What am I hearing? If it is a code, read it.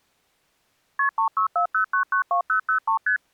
Multi-frequency trunk signalling (R1, as on North American trunks), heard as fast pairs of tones, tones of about 100 ms. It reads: KP 3640992003 ST